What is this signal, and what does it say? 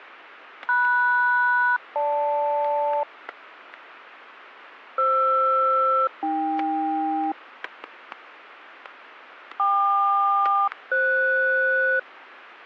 Aircraft SELCAL, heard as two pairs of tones, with static crashes. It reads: MS-GL FR-AK KQ-FS